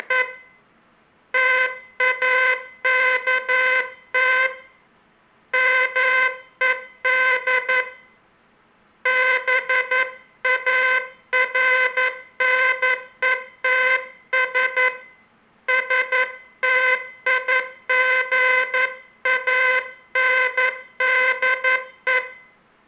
Morse code, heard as a buzzer, hand-sent with a paddle, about 11 wpm, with room echo. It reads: … TAKT MED BARNETS STIGANDE